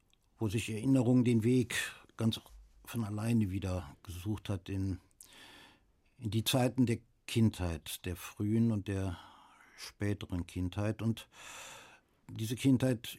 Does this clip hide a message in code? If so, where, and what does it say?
No, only speech in German.